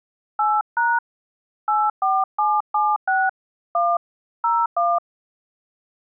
DTMF, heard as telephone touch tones, dialled by hand, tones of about 220 ms. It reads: 8# 84776 1 01